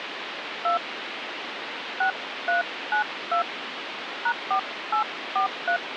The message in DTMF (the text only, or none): 2 6392 #4843